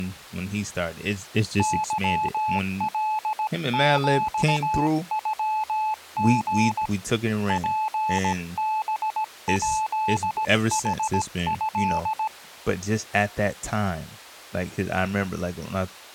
Morse code (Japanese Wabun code), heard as a keyed tone, hand-sent with a paddle, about 17 wpm, 870 Hz, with speech in English. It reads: ケカヒノリ ツハヱヌト